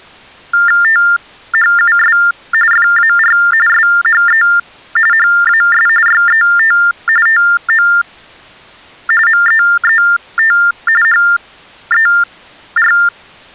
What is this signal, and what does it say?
TTY/TDD text telephone tones (45.45 baud Baudot), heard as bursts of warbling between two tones, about 400 Hz shift, 1600 Hz centre. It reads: THUS FAR SHE HAS YET TO MEET HER